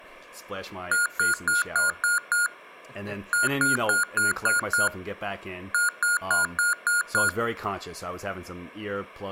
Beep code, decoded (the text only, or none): 6-6-6